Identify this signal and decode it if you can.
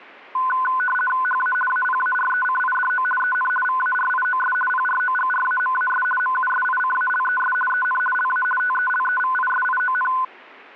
RTTY (50 baud, 450 Hz shift), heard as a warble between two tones, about 1260 Hz centre. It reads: HA APARECIDO EN VARIOS PROGRAMAS MUSICALES EN LA TELEVISION